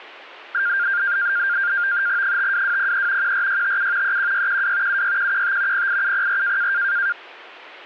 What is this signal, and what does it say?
NAVTEX (SITOR-B), 100 baud, 170 Hz shift, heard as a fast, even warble, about 1500 Hz centre. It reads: 52203 14657 31612 76115 08704